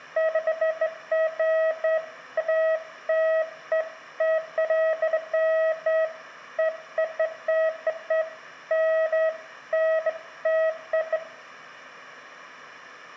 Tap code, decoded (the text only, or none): none